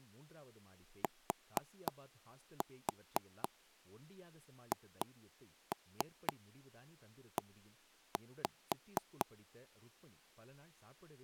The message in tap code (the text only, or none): THE